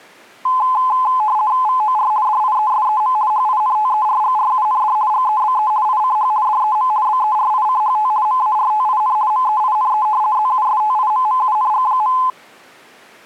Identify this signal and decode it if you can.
RTTY (50 baud, 170 Hz shift), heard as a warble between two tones, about 940 Hz centre. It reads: VOR DIESEM HINTERGRUND GEBE ICH DEM BERICHT MARTIN MEINE ZUSTIMMUNG.